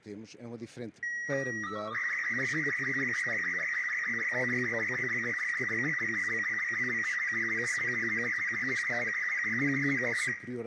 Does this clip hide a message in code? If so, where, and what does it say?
Yes: SSTV (slow-scan television), Robot 36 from 1.0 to 10.3 s, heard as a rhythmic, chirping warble, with room echo.